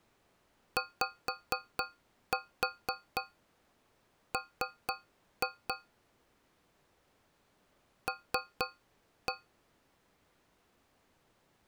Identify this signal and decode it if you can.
Tap code, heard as taps on a metal pipe, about 4 knocks a second. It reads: YM L